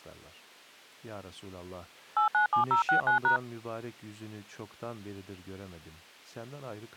DTMF, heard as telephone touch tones, dialled by machine, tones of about 110 ms, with speech in Turkish. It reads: 897069#